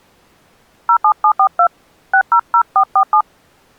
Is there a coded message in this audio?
Yes: DTMF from 0.9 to 3.2 s, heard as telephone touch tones, dialled by hand, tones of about 80 ms. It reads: 07742 600447